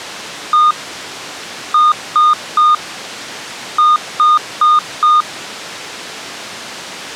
Beep code, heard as beeps, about 1220 Hz. 1-3-4.